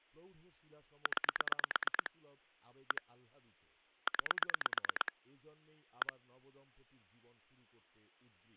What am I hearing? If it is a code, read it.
Pulse dialling, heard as clicks on a phone line, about 8 pulses a second, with speech in Bangla. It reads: 9 1 9 1